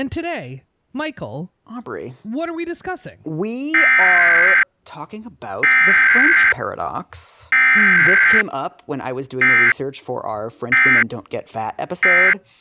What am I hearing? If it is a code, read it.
Emergency Alert System (SAME) tones (header bursts, then end-of-message bursts), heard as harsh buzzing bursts, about 520.83 baud, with speech in English.